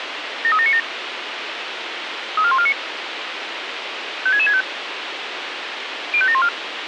Five-tone selective call (ZVEI), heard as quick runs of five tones, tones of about 70 ms, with radio hiss. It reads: 73797 34149 56665 05714